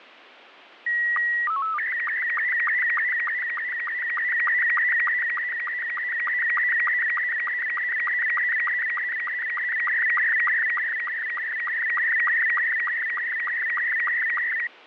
SSTV (slow-scan television), Robot 72, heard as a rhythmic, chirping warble.